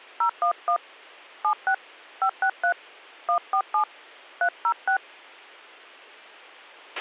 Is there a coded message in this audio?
Yes: DTMF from 0.2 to 5.0 s, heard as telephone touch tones, dialled by hand, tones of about 80 ms, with a squelch burst at the end. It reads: 011 76 563 147 306